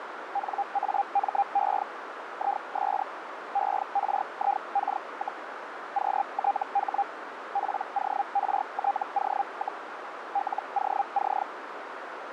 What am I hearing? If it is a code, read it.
Hellschreiber (Feld-Hell, 122.5 baud), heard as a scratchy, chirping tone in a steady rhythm, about 800 Hz, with radio static and a narrow filter. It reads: NAME IS ERIK, QTH PORTO, LOC